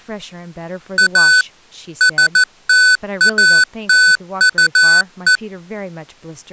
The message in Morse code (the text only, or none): A STATUE